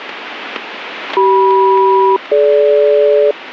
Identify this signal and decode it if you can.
Aircraft SELCAL, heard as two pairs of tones. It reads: CM-DG